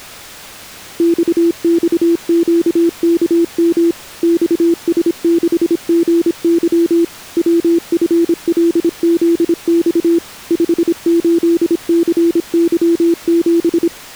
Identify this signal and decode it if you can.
Morse code, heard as a keyed tone, machine-sent, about 26 wpm, 340 Hz. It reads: XXQKM XS6GY WFLZX 58CY7